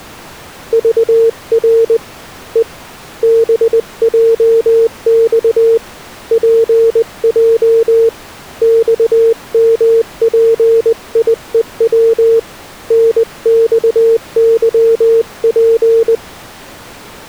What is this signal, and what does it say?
Morse code, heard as a keyed tone, hand-sent with a paddle, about 20 wpm, 460 Hz. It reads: VR E BJX PJ XMPIEW NXYP